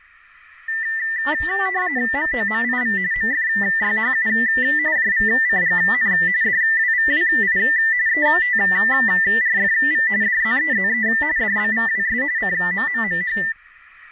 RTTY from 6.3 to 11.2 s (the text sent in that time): DWVWI ETRFV DZEZE